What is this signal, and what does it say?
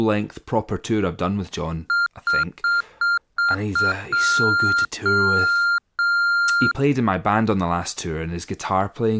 Beep code, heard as beeps, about 1400 Hz, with speech in English. 6 short, 3 long.